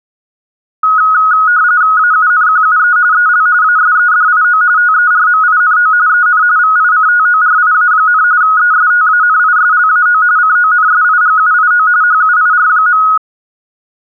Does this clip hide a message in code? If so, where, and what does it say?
Yes: RTTY (45.45 baud, 170 Hz shift) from 0.8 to 13.2 s, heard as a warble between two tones, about 1360 Hz centre. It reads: AUNQUE EL ASEDIO TERMINO EN VICTORIA, ESTANISLAO CONSIGUIO HUIR.